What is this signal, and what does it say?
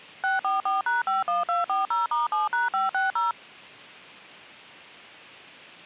DTMF, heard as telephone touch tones, dialled by machine, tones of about 160 ms. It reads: 644#51240*7#560